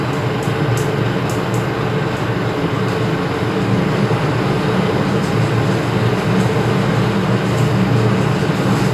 The noise inside a lift. There is no code.